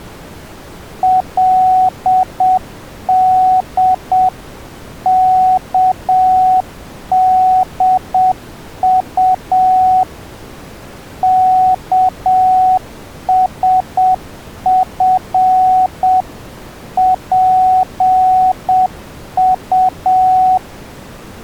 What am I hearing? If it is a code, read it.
Morse code (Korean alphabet), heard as a keyed tone, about 7 wpm, 740 Hz. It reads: 그의 연지